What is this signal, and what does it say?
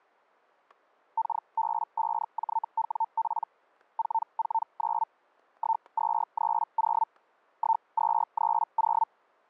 Hellschreiber (Feld-Hell, 122.5 baud), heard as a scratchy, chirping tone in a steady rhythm, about 900 Hz, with static crashes. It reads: KB5JWP 449 1230 1230